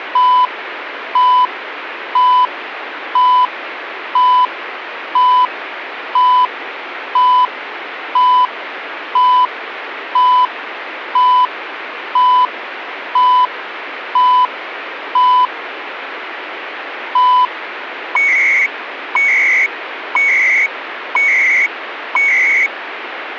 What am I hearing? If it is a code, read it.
Radio time signal (CHU, Canada), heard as beeps and data bursts, one a second, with radio static.